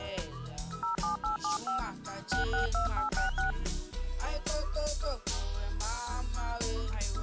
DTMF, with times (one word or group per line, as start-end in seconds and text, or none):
0.8-1.8 07875
2.3-3.5 662866